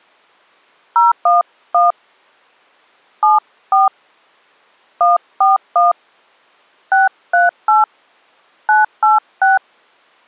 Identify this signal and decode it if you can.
DTMF, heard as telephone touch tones, dialled by hand, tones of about 160 ms. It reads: 011 74 141 638 986